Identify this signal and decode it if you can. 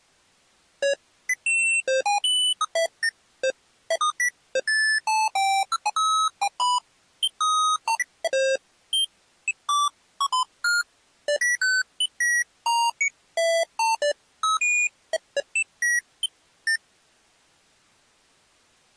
Electronic bleeps of random pitch and length. There is no code.